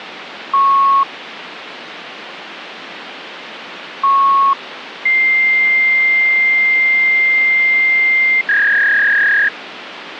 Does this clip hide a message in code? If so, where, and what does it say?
Yes: fax machine handshake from 0.5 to 9.5 s, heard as beeps, a long tone and a warble, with phone line noise.